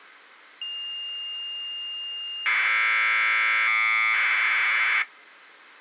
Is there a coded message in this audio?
Yes: Commodore tape loading (standard loader) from 0.6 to 5.0 s, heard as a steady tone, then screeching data.